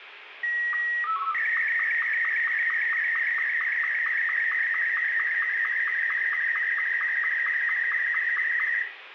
SSTV (slow-scan television), Martin M2, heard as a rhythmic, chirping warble, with radio static and room echo.